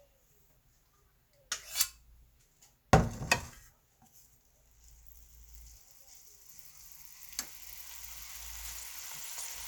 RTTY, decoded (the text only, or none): none